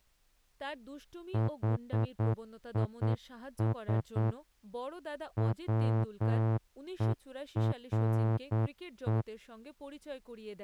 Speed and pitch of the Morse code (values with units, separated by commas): 8 wpm